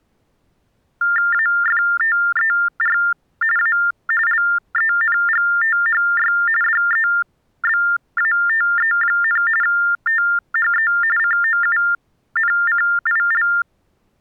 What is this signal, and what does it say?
TTY/TDD text telephone tones (45.45 baud Baudot), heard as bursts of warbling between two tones, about 400 Hz shift, 1600 Hz centre. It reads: AFTER A LENGTHY DEBATE, THE COUNCIL